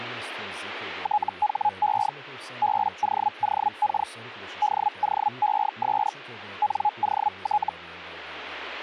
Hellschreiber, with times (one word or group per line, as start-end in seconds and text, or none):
1.0-2.1 THE
2.6-4.1 BOOK
4.6-6.1 DOES
6.6-7.7 NOT